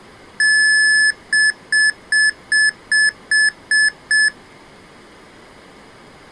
Beep code, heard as beeps from a small speaker, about 1750 Hz. 1 long, 8 short. In AMI BIOS tables: display or retrace test failure.